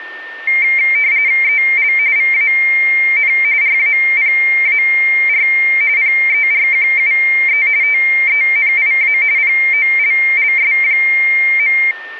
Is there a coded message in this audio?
Yes: RTTY (45.45 baud, 170 Hz shift) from 0.5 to 11.9 s, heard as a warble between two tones, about 2200 Hz centre, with a steady whistle near 1810 Hz. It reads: EL VAN RAPAR PERQUE TENIA POLLS.